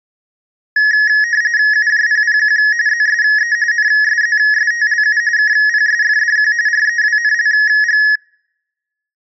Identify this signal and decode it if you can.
RTTY (45.45 baud, 170 Hz shift), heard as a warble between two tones, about 1800 Hz centre. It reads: UJPPQ ZSE NSZSTLU KPSFDQ REWNLG